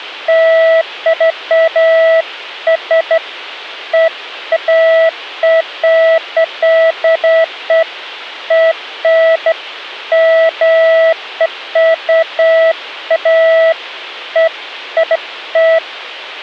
Beeps of irregular length. There is no code.